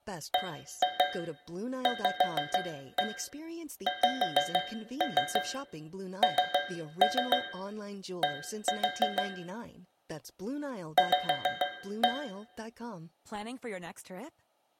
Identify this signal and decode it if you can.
Tap code, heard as taps on a metal pipe, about 6 knocks a second, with room echo and speech in English. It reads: BVXND V